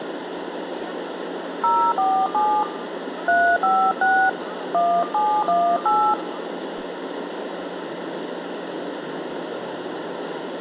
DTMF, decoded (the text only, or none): 047 356 1718